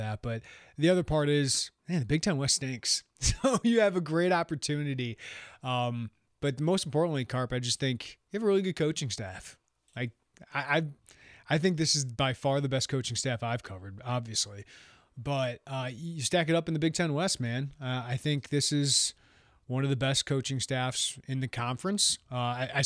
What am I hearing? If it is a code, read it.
Speech in English. There is no code.